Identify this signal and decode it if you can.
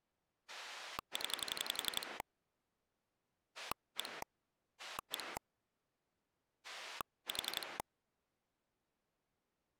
Pulse dialling, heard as a rotary dial, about 11 pulses a second. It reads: 0 1 1 4